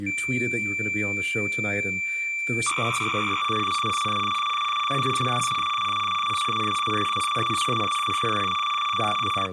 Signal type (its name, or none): cassette data (Kansas City type)